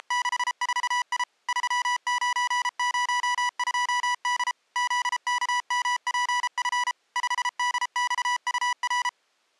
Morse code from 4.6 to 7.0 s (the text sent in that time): ZKMPF